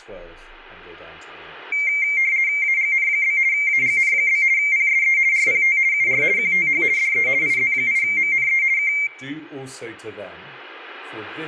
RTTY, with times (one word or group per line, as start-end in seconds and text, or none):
2.6-3.4 AGN?
3.5-4.4 AGN?
4.6-5.2 PSE
5.3-5.8 RPT
5.9-6.2 UR
6.4-6.8 QTH
7.0-7.3 DE
7.4-8.6 IZ8MNE
8.8-8.9 K